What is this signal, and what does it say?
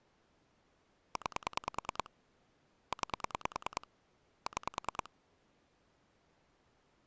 Pulse dialling, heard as clicks on a phone line, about 10 pulses a second. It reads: 9 9 6